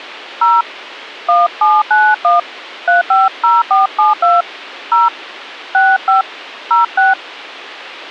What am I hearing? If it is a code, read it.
DTMF, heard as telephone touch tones, dialled by hand, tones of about 190 ms. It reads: 0 1791 350472 0 65 06